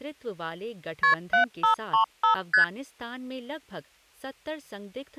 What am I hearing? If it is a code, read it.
Multi-frequency trunk signalling (R1, as on North American trunks), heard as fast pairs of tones, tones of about 110 ms, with speech in Hindi. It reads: KP 7535 ST